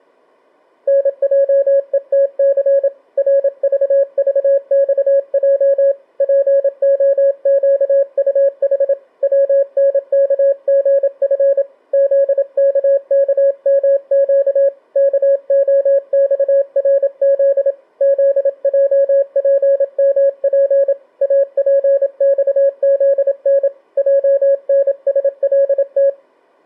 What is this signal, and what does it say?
Morse code, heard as a keyed tone, hand-sent with a paddle, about 27 wpm, 550 Hz. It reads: NJETC RVVXJ POQUH WNKGF ZKKMQ KOXRZ ZJPMP APXZN JNSLT